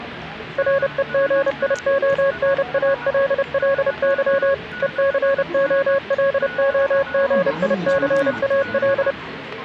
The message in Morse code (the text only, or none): REGIONALLY ECOLOGICAL